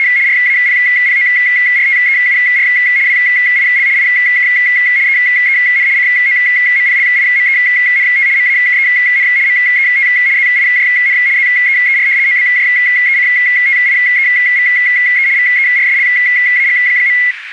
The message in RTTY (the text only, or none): … RAPPORTEUR WIL IK EEN COMPLIMENT MAKEN MET ZIJN ZEER OBJECTIEVE VERSLAG.